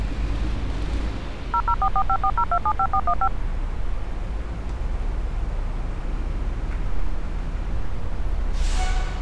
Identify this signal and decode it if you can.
DTMF, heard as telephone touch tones, dialled by machine, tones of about 60 ms, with street noise. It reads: 0044540275415